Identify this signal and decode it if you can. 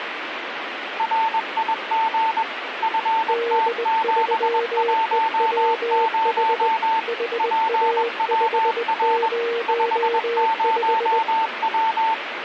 Morse code, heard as two keyed tones, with radio static. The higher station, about 21 wpm, 890 Hz: RIG FT710 PWR 50W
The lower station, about 20 wpm, 470 Hz: D3EWH HA505